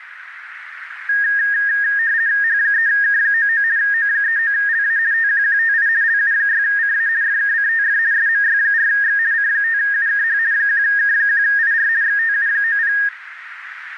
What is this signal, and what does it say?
RTTY (50 baud, 170 Hz shift), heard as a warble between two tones, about 1750 Hz centre, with radio static and a narrow filter. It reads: H3K99 O39LA TQQTI LU6CA FKCTF SMY4X C5UKH 1K1IR XTU90